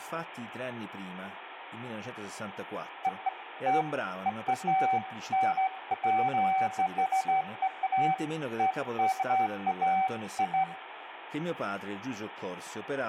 Beeps of irregular length, with phone line noise, room echo and speech in Italian. There is no code.